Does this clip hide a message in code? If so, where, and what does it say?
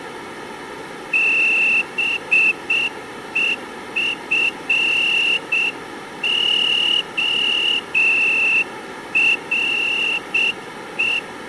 Yes: Morse code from 1.1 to 11.2 s, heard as a whistle, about 7 wpm. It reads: BEFORE